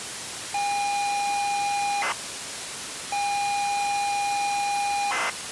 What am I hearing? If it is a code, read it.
ZX Spectrum tape loading, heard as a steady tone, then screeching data, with tape hiss.